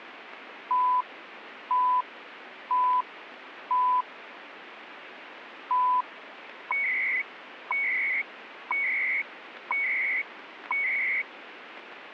Radio time signal (CHU, Canada), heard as beeps and data bursts, one a second, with radio static.